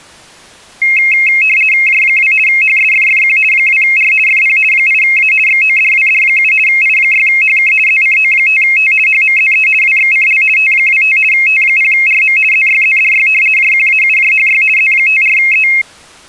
RTTY (50 baud, 450 Hz shift), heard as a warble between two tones, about 2350 Hz centre. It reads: J2 HSFFQ 2R FP 8A XODWD7 I6HK ZCO5T HMZE WXCL T25 T0RM ZYZDY JQAUJHY Z54E